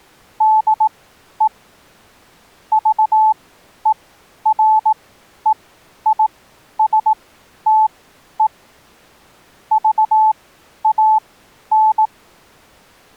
Morse code, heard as a keyed tone, machine-sent, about 18 wpm, spaced as for 11 wpm, 870 Hz. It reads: DE VEREISTE VAN